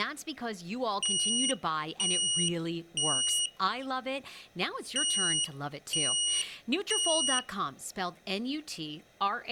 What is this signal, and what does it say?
Alarm pattern, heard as an alarm's beeps, played twice, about 2900 Hz, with speech in English. Temporal three. Smoke or fire, evacuate.